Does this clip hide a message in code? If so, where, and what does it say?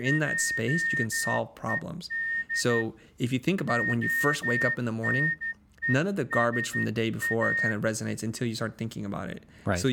Yes: Morse code (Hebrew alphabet) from 0.0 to 7.8 s, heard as a whistle, hand-sent with a straight key, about 12 wpm, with speech in English. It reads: עוד הנושא